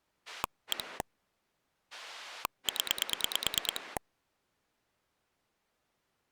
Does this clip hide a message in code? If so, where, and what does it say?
Yes: pulse dialling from 0.3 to 4.0 s, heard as a rotary dial, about 9 pulses a second. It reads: 1 0